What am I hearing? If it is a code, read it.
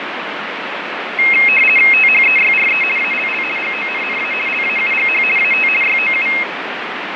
RTTY (50 baud, 450 Hz shift), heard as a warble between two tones, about 2350 Hz centre, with radio static and fading. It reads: THEYRE ALL GONNA LAUGH AT YOU